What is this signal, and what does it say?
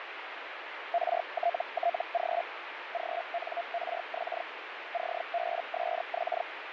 Hellschreiber (Feld-Hell, 122.5 baud), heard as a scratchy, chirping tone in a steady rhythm, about 690 Hz, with radio static. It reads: RTTG GNRX CBSX